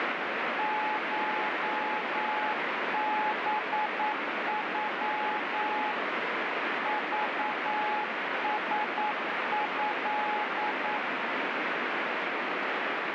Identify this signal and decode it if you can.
Morse code (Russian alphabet), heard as a keyed tone, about 9 wpm, 850 Hz, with heavy radio static. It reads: ШБЮ ЖСЭ